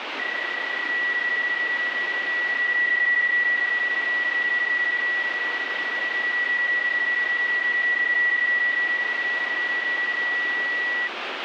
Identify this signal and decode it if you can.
PSK31 (31.25 baud), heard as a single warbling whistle, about 1950 Hz, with radio static.